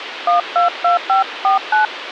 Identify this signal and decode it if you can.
DTMF, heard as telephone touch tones, dialled by hand, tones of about 130 ms, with radio hiss. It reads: 122549